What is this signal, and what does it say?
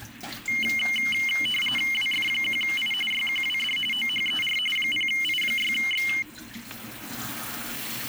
RTTY (45.45 baud, 850 Hz shift), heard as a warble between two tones, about 2550 Hz centre, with static crashes and kitchen noise. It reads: WF1I YQWD OHER 0I6X